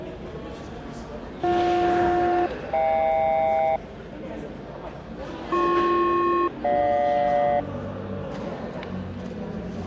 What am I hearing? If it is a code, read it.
Aircraft SELCAL, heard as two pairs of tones, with the noise of a crowd indoors. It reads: BJ-HK BP-GJ